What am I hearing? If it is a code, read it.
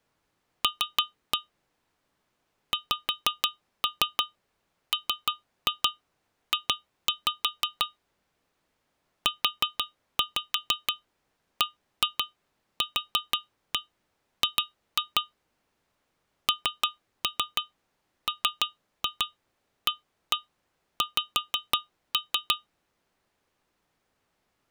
Tap code, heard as taps on glass, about 6 knocks a second. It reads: L XMJ UBQG NMAX